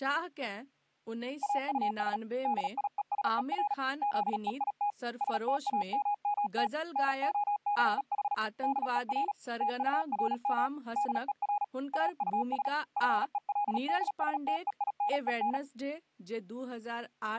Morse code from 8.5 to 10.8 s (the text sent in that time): DER TURM